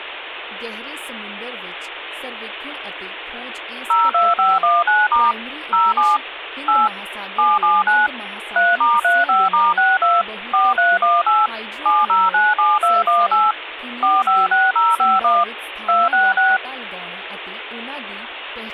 DTMF, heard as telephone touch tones, dialled by machine, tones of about 200 ms, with phone line noise and speech in Punjabi. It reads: 02519* 07 8 779 3*35*62 4318 7097218 456051 266